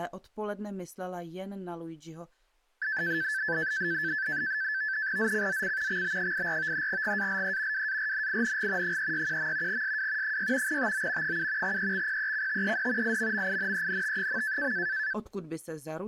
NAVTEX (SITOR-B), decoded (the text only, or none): ZCZC XB84 GALE WARNING 361. SW 6 TO 7 EXPECTED IMMINENT.